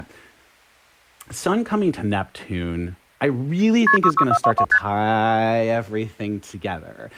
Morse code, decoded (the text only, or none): none